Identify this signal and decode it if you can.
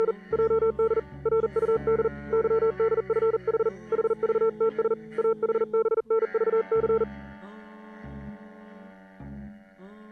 Morse code, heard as a keyed tone, hand-sent with a paddle, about 40 wpm, 450 Hz. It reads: … JD RUD YDFH HVTS AHBNVC